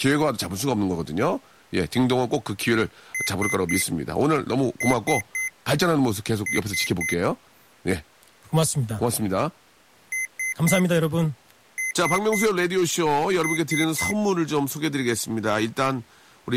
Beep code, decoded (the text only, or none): 3-3-3